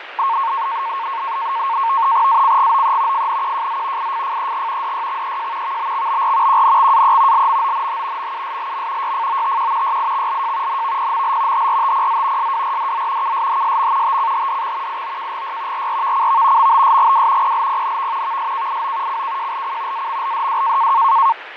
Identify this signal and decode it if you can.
NAVTEX (SITOR-B), 100 baud, 170 Hz shift, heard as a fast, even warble, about 1000 Hz centre, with radio static and fading. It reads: ACGOE FNQJZ IFFEG DYXEJ VBXBR QNXAE LMONH MUSLM YFOTQ YIXLJ NVPML HRTPZ SWRDZ KSHSM TCHDX IOKGY RRVCV MBSGW PLPNV VSKIO CKJLC AMLDW